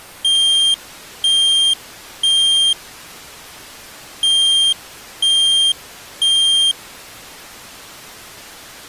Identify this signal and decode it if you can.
Alarm pattern, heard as an alarm's beeps, played twice, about 3200 Hz. Temporal three. Smoke or fire, evacuate.